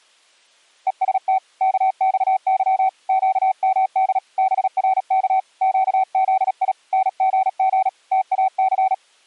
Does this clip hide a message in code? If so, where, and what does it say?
Yes: Morse code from 0.8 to 9.0 s, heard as a keyed tone, hand-sent with a paddle, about 37 wpm, 760 Hz. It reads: EST KXY QMD BRK QZI NGG TAC